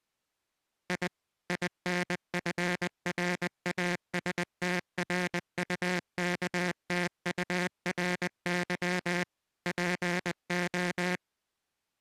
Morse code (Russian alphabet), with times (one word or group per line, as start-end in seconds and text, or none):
0.9-1.1 И
1.5-9.2 ИНФРАСТРУКТУРЫ
9.7-11.2 ПО